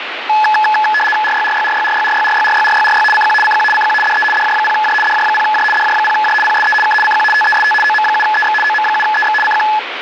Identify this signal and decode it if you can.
RTTY (75 baud, 850 Hz shift), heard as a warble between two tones, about 1280 Hz centre, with radio static. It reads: RYRYRYRYRYRYRYRYRY CQ CQ CQ DE DJ0J DJ0J DJ0J PSE K CQ TEST OM7EX OM7EX CQ